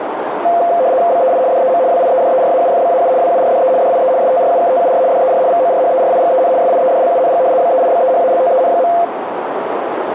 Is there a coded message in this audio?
Yes: RTTY (75 baud, 170 Hz shift) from 0.4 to 9.0 s, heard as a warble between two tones, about 600 Hz centre, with radio static and a narrow filter. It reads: BEI DEM WIEDERAUFBAU WURDE DIE STRUKTUR DER VORHERIGEN SIEDLUNG BEIBEHALTEN.